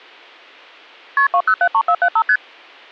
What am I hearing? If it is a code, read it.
Multi-frequency trunk signalling (R1, as on North American trunks), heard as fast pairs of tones, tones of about 70 ms. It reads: KP 2073475 ST